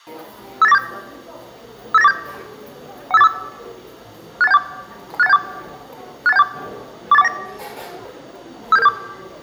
Five-tone selective call (EIA), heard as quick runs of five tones, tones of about 30 ms, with room echo and the noise of a cafe. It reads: 58947 58947 15845 68174 68174 68174 48419 57774